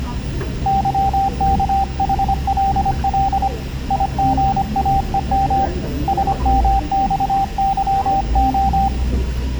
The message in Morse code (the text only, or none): YKHLL IGAEM SMXYO